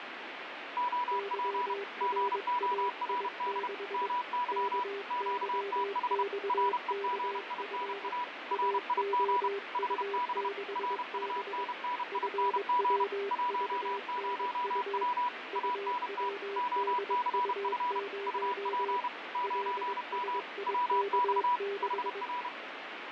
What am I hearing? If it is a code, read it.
Morse code, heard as two keyed tones, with radio static and fading. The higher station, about 31 wpm, 980 Hz: OP GORD MY QTH REGINA RIG HB RUNNING 10W ANT OCF UP 9M WX HR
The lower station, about 22 wpm, 400 Hz: YRAI6 KYXKF AOU6B FWVNU UWDU0 LSIK6